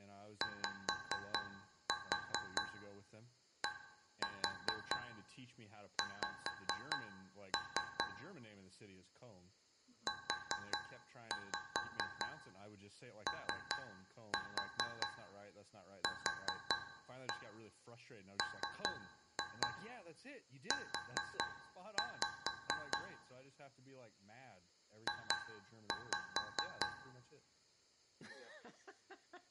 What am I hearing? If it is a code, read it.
Tap code, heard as taps on a metal pipe, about 4 knocks a second, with room echo and speech in English. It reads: YDX UOQMU J